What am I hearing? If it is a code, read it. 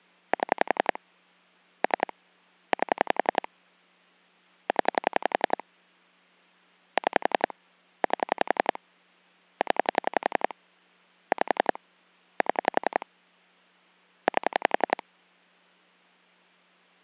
Pulse dialling, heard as clicks on a phone line, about 11 pulses a second. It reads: 7 3 8 0 6 8 0 5 7 8